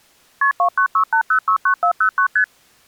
Multi-frequency trunk signalling (R1, as on North American trunks), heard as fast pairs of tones, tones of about 90 ms. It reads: KP 2968069409 ST